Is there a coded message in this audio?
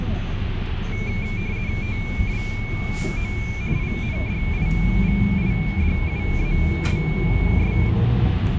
Yes: RTTY (50 baud, 170 Hz shift) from 0.9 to 7.9 s, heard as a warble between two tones, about 2300 Hz centre, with radio static and the noise inside a bus. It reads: TWO INDIVIDUALS